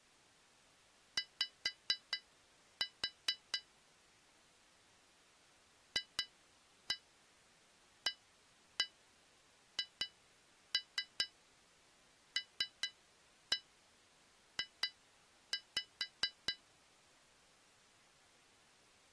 Tap code, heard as taps on glass, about 4 knocks a second. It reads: Y FAHLJ